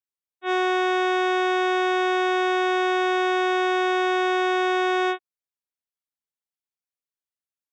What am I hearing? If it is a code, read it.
Ship horn signal, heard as a ship's horn, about 370 Hz. 1 long. At sea: a vessel nearing a blind bend, or under power and making way in fog.